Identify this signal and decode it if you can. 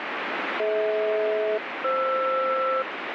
Aircraft SELCAL, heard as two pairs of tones, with radio static. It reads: DH-FR